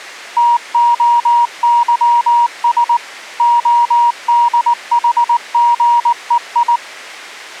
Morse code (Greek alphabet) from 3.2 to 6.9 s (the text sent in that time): ΟΔΗΓΕΙ